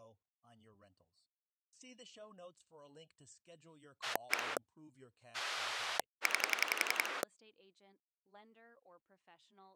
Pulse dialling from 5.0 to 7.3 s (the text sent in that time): 9